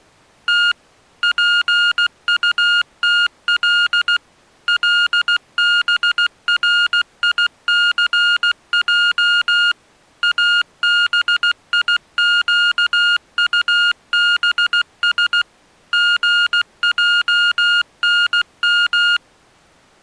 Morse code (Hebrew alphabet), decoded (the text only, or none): ת פטתל לבריסע אביקטבש גענם